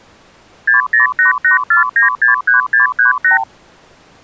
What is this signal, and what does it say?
Multi-frequency trunk signalling (R2, with the far end's replies), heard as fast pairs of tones, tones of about 130 ms. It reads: 60884963638